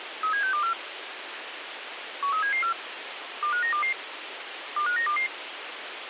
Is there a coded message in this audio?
Yes: five-tone selective call (CCIR) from 0.2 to 5.3 s, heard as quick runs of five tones, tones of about 100 ms, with radio hiss and a squelch burst at the end. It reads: 37624 13774 25922 25922